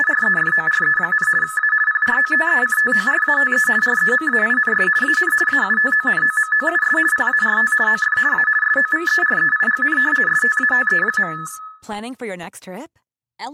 RTTY (50 baud, 450 Hz shift), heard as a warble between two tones, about 1500 Hz centre, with room echo and speech in Spanish. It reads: … A PROTECTORATE REMAINS AN AUTONOMOUS PART OF A SOVEREIGN STATE.